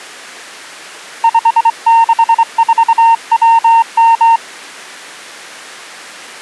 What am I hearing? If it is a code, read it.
Morse code, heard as a keyed tone, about 24 wpm, 920 Hz. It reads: 564WM